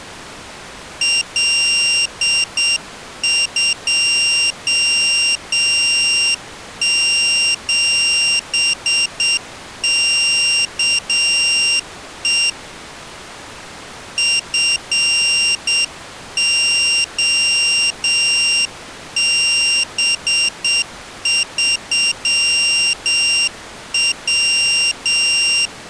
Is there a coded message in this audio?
Yes: Morse code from 1.0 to 25.7 s, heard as a high beeper, hand-sent with a straight key, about 7 wpm, 2800 Hz. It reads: L27KE FOB3W